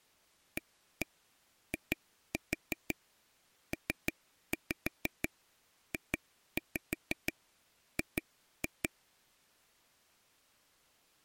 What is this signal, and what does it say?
Tap code, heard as taps on a table, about 6 knocks a second. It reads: AIPJG